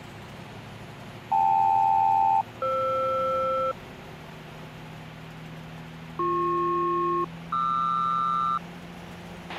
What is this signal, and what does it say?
Aircraft SELCAL, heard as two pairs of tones, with a squelch burst at the end. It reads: KL-FR BP-QR